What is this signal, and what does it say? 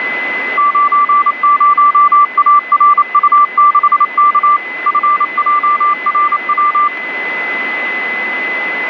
Morse code, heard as a keyed tone, machine-sent, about 28 wpm, 1170 Hz, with radio static and a steady whistle near 2020 Hz. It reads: 90ARU6K FJRW